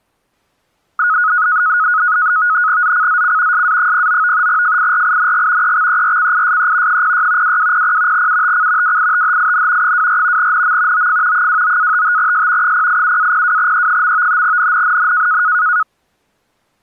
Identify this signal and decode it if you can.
NAVTEX (SITOR-B), 100 baud, 170 Hz shift, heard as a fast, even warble, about 1360 Hz centre. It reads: ZCZC SA09 FIRING EXERCISE 06 2200 UTC WITHIN 24 NM OF 29-55S 087-02E. NNNN